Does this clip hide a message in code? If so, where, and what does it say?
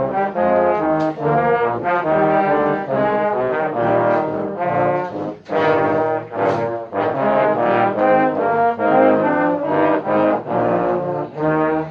No.